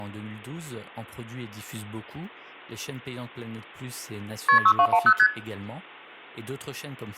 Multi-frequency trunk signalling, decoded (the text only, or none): KP 6210 ST